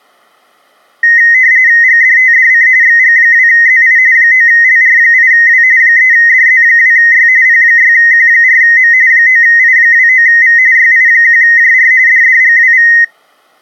RTTY (45.45 baud, 170 Hz shift), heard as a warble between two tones, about 1950 Hz centre. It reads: GDTDC XG2ZI 9LR8W 3DZ2Y P6Q4M 9I29V YI1JR DDGWV